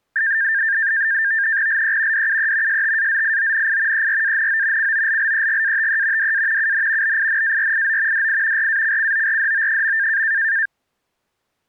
NAVTEX (SITOR-B), 100 baud, 170 Hz shift, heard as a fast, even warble, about 1700 Hz centre. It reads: LE DUE STAZIONI ERANO COLLEGATE DA UN BINARIO DI RACCORDO.